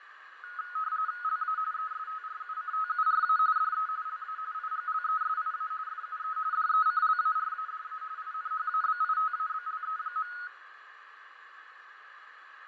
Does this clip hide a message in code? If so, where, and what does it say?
Yes: RTTY (45.45 baud, 170 Hz shift) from 0.4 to 10.5 s, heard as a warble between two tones, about 1360 Hz centre, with radio static, fading and a narrow filter. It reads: LA ESTRUCTURA DE LA IGLESIA FUE DECLARADA INHABITABLE.